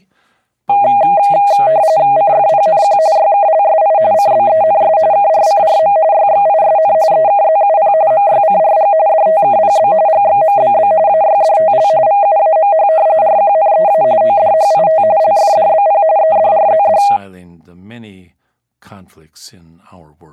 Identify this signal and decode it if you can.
RTTY (45.45 baud, 170 Hz shift), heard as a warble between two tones, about 720 Hz centre, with speech in English. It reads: CFPNQ YKLSI CBENS KRCRM YXISN EKZUP MYCRG DTKPB GXMBB AYDTL VUAMH RQNEA ODHIT LFDBP EDRZD